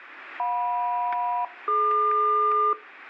Aircraft SELCAL, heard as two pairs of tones, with static crashes. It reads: JM-DQ